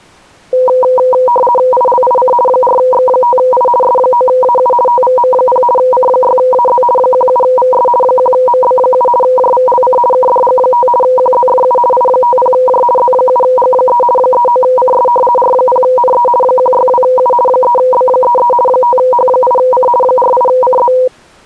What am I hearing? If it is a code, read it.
RTTY (50 baud, 450 Hz shift), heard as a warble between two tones, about 740 Hz centre. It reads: ILIC 4X5I S9AU TVM0 C6AZ 17VS 1MB7 JVLC KDG5 QZFU I50J Z7G3 39CS R0NE 162U 3B33 5H8C 48CZ